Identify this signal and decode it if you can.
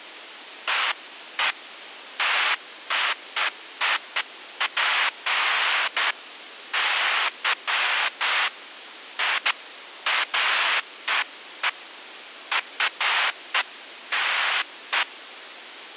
Bursts of noise, with radio hiss. There is no code.